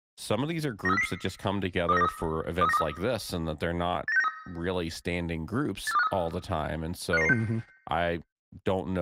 Five-tone selective call (EEA), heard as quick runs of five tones, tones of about 40 ms, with speech in English. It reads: 93400 23923 23923 89693 84253 55996